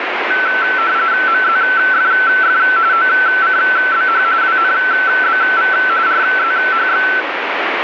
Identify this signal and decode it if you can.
RTTY (45.45 baud, 170 Hz shift), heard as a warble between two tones, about 1430 Hz centre, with radio static. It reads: MZFF OCBH WNBV RZHX